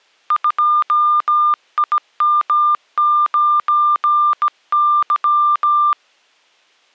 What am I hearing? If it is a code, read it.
Morse code, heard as a keyed tone, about 17 wpm, 1200 Hz. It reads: 2IM9Y